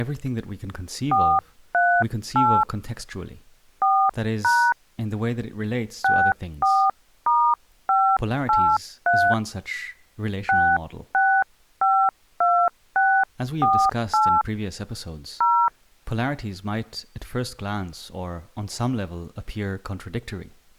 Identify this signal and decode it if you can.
DTMF, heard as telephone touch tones, dialled by hand, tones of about 280 ms, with speech in English. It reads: 438 4# 64*583 6652648 0